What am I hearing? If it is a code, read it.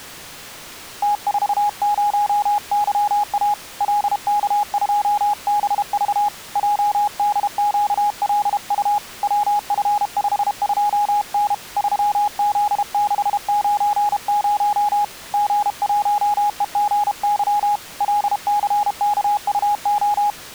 Morse code, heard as a keyed tone, hand-sent with a paddle, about 32 wpm, 830 Hz. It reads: T40YA LK2BV JDQLU WF52N 3Z690 G1EGY LCKUO